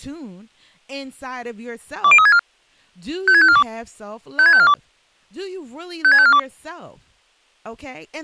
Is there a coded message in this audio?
Yes: five-tone selective call (ZVEI) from 2.0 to 6.4 s, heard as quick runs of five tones, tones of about 70 ms, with speech in English. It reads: 20364 56542 56542 56542